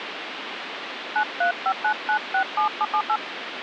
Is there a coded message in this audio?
Yes: DTMF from 1.2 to 3.2 s, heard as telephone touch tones, dialled by hand, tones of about 80 ms, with phone line noise. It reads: 9359967778